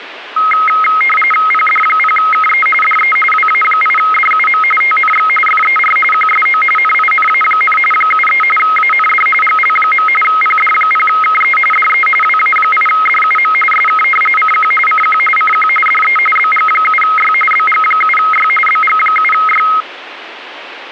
RTTY (45.45 baud, 850 Hz shift), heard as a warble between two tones, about 1700 Hz centre, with radio static. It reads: PD0KE DE WA8DUM TNX FER QSO NINA, 73 AND GL. PD0KE DE WA8DUM SK CQ CQ CQ DE BG7Y BG7Y BG7Y